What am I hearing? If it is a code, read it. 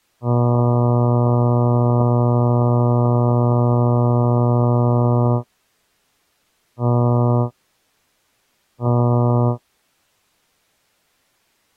Ship horn signal, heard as a ship's horn, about 120 Hz. 1 long, 2 short. At sea: a vessel in fog that is sailing, fishing, towing or hampered.